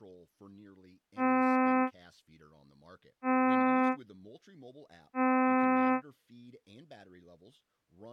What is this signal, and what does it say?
Ship horn signal, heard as a ship's horn, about 260 Hz, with speech in English. 3 short. At sea: I am operating astern propulsion.